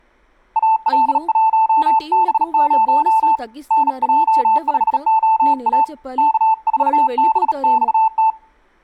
Morse code, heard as a keyed tone, hand-sent with a bug key, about 37 wpm, 880 Hz, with speech in Telugu. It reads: AL1B0 NJ5OA K4BXT